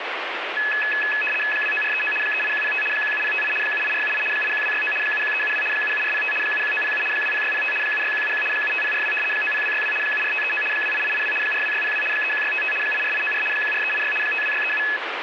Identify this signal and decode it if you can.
RTTY (75 baud, 850 Hz shift), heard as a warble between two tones, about 2150 Hz centre, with radio static. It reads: 29439 38105 17058 78478 81269 71372 77405 71907 20605 76171 75042 90262 74539 28882 42602 31655 84894 14386 52637